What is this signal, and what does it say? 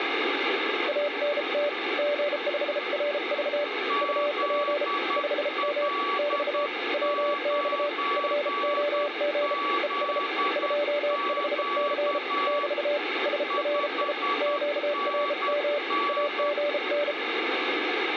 Morse code, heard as two keyed tones, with radio static. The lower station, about 33 wpm, 580 Hz: ANT G5RV UP 5M <BT> WX FOG ES 25C <BT> SRI QRM AGN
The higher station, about 10 wpm, 1140 Hz: ZL9ZQ 5NN